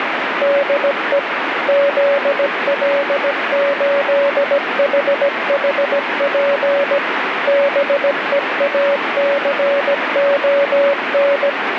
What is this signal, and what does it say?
Morse code, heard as a keyed tone, machine-sent, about 17 wpm, 560 Hz, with radio static. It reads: DE ZL8HHP BEACON